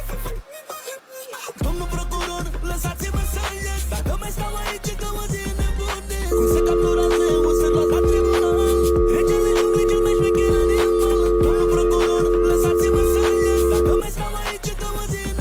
Telephone call progress tone (North American or UK plan), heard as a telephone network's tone, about 350, 440 Hz, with room echo. Dial tone.